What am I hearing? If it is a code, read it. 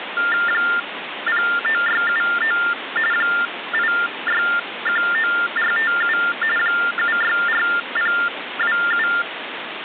TTY/TDD text telephone tones (45.45 baud Baudot), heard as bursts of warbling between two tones, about 400 Hz shift, 1600 Hz centre, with phone line noise. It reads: 09679 8619457 764027